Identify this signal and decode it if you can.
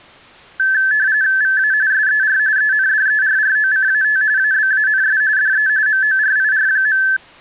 RTTY (45.45 baud, 170 Hz shift), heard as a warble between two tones, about 1650 Hz centre. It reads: VA SER ENDERROCAT ABANS DE MORIR.